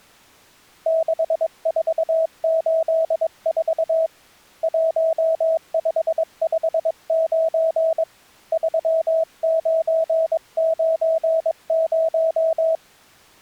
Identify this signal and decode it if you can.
Morse code, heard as a keyed tone, hand-sent with a paddle, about 22 wpm, 650 Hz. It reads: 6484 1559 3990